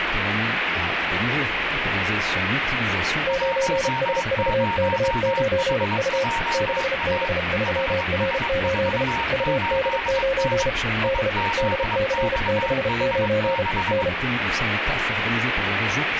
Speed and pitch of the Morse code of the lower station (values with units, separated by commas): 32 wpm, 540 Hz